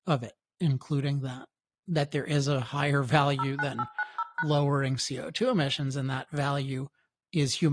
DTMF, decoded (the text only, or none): 09890#